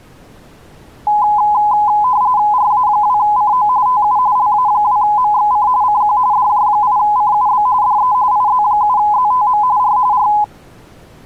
RTTY (45.45 baud, 170 Hz shift), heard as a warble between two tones, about 920 Hz centre. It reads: RA2CO TU LA2MXC CQ DJ8CUB DE IZ7ZTM R R